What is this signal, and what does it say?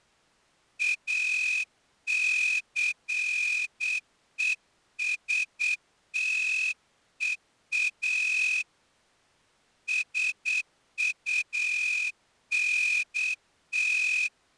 Morse code, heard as a whistle, hand-sent with a straight key, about 8 wpm. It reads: ACESTEA SUNT